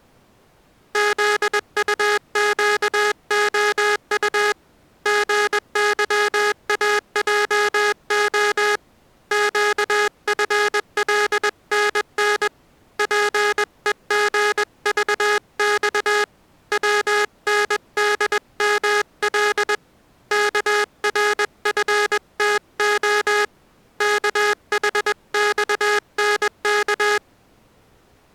Morse code, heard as a buzzer, hand-sent with a paddle, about 21 wpm. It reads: ZUQOU GYAJO QFLNN PEGVX WNDML KRFTO KHXNK